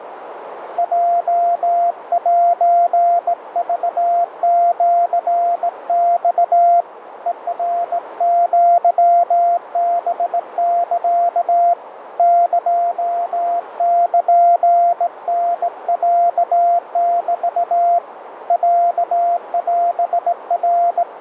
Morse code (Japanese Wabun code), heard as a keyed tone, hand-sent with a straight key, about 18 wpm, 690 Hz, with radio static and a narrow filter. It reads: ヲセクシマ ヘナアハサ エルタロメ …